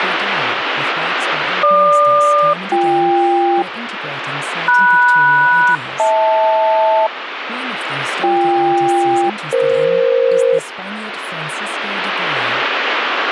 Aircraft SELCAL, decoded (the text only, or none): GQ-BK MS-HL BK-EF